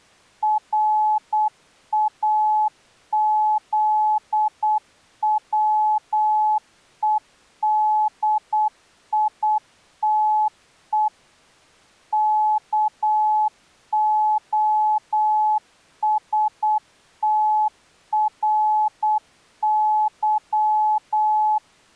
Morse code (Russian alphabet), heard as a keyed tone, machine-sent, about 8 wpm, 860 Hz. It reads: РАЗВЕДИТЕ КОСТРЫ